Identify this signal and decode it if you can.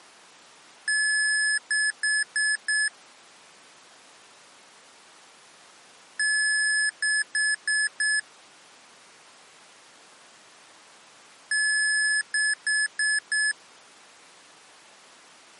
Beep code, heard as beeps from a small speaker, played three times, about 1700 Hz. 1 long, 4 short.